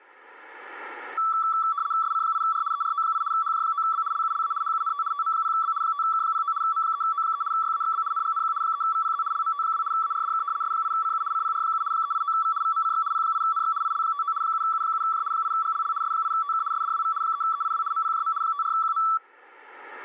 RTTY (75 baud, 170 Hz shift), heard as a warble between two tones, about 1230 Hz centre. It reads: SC8R ERO8 HJ9B LULA HUNT TM0B 5K09 M3O3 YAXB NGNQ 3VPZ LMT2 ARDK S8CU CPR7 389V VMCX P8NX IL59 7U7J 8GLL S8TK SDWV 3EIW MPJM 54QM